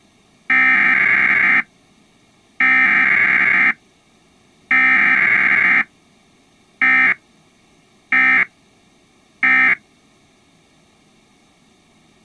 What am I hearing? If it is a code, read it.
Emergency Alert System (SAME) tones (header bursts, then end-of-message bursts), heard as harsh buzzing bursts, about 520.83 baud.